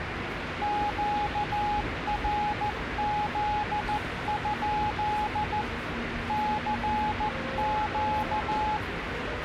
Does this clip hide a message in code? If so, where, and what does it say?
Yes: Morse code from 0.6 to 8.8 s, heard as a keyed tone, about 14 wpm, 840 Hz, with radio static and the noise of a subway station. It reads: QRZ? CQ